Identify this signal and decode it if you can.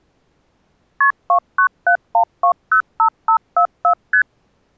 Multi-frequency trunk signalling (R1, as on North American trunks), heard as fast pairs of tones, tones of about 90 ms. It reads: KP 2971205544 ST